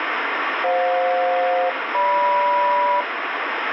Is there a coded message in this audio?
Yes: aircraft SELCAL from 0.6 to 3.0 s, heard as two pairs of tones, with radio static. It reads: FJ-GM